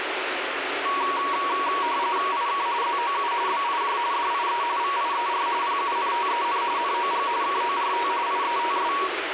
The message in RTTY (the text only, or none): IK ZOU BIJ DIE VIER PUNTEN NOG KORT IETS